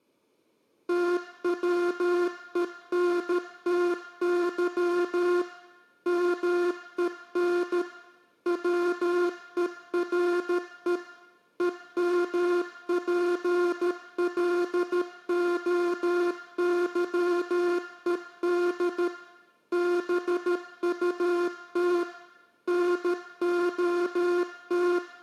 Morse code, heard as a buzzer, machine-sent, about 13 wpm, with room echo. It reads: TWENTY MEN WERE EMPLOYED BUT NOT